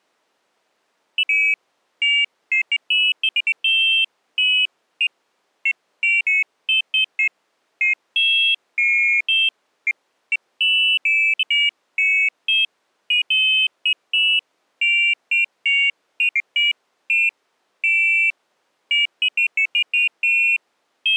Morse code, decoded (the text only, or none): none